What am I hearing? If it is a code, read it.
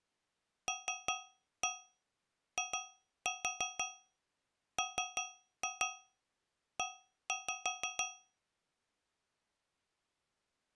Tap code, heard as taps on a metal pipe, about 5 knocks a second. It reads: LIME